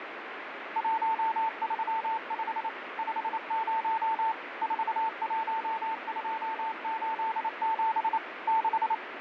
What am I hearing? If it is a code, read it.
Morse code, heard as a keyed tone, machine-sent, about 28 wpm, 890 Hz, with radio static. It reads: 135 50 41287 6